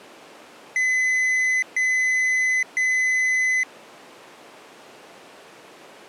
Beep code, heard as a piezo beeper, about 2000 Hz. 3 long. In IBM BIOS tables: keyboard card error.